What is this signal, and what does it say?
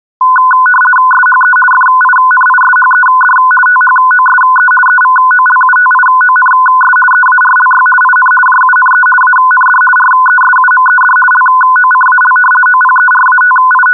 RTTY (50 baud, 450 Hz shift), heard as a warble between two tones, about 1250 Hz centre. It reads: SHE FINISHED THOSE EVOLUTIONS EARLY IN JUNE AND RESUMED LOCAL …